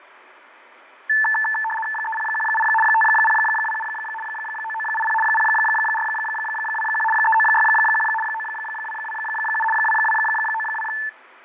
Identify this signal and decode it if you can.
RTTY (75 baud, 850 Hz shift), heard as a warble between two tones, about 1320 Hz centre, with radio static and fading. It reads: 3018 5027 9980 0421 3961 9227 2292